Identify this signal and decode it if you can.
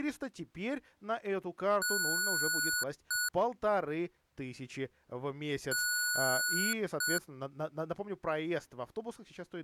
Beep code, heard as beeps from a small speaker, played twice, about 1470 Hz, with speech in Russian. 1 long, 1 short. In IBM BIOS tables: system board problem.